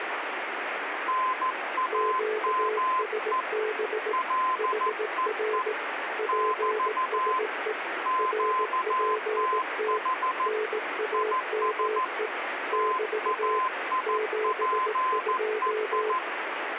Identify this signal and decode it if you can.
Morse code, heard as two keyed tones, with radio static. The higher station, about 14 wpm, 1030 Hz: NAME LEE <BT> QTH IS TAIPEI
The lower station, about 18 wpm, 430 Hz: QSB HR PSE RPT NAME <BT> 72